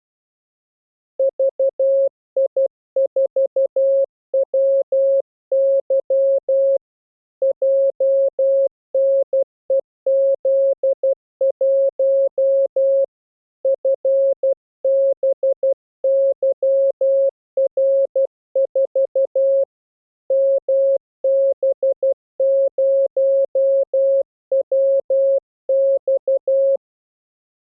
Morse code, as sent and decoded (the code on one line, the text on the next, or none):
...- .. ....- .-- -.-- / .--- -. . --.. .---- / ..-. -... -.-- .-. ....- / -- -... ----- .-- -..-
VI4WY JNEZ1 FBYR4 MB0WX